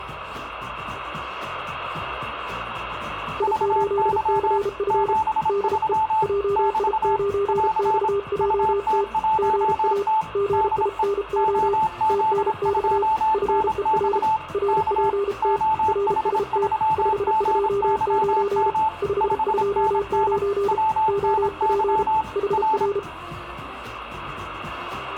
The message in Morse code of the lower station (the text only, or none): I8CF DE JI9XJT GA GINO TNX FER RPT RST 529 529 OP HR